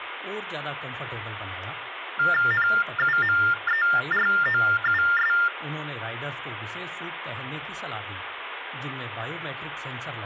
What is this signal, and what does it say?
TTY/TDD text telephone tones (45.45 baud Baudot), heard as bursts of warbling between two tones, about 400 Hz shift, 1600 Hz centre, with phone line noise and speech in Hindi. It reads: NUMEROUS